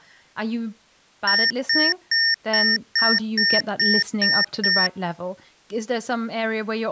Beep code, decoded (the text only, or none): 9 short